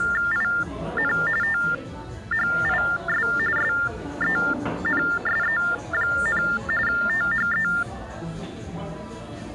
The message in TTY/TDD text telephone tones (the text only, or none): IN THIS SENSE, THE